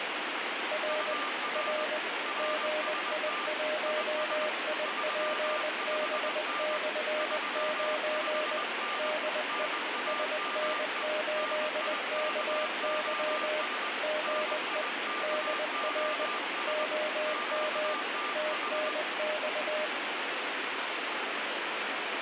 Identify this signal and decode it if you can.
Morse code, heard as two keyed tones, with heavy radio static. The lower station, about 20 wpm, 610 Hz: R R GI1IPB/9 DE SN8KY GE DR OM TNX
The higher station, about 21 wpm, 1190 Hz: UR RST IS 35N 35N NAME NIKOS NIKOS QTH